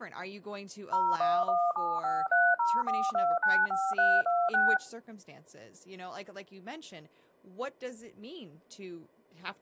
DTMF, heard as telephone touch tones, dialled by machine, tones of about 230 ms, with speech in English. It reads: 01175304295326